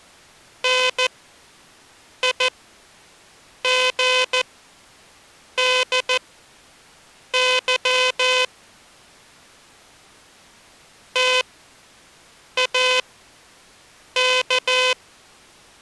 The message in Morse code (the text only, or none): NIGDY TAK